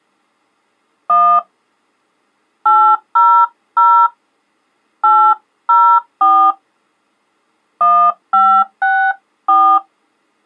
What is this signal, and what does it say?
DTMF, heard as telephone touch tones, dialled by hand, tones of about 300 ms. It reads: 1 800 804 1564